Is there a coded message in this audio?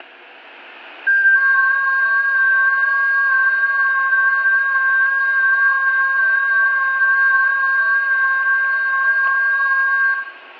Yes: FT8 (several signals at once) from 1.1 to 10.1 s, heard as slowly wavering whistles, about 6.25 baud, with static crashes and room echo.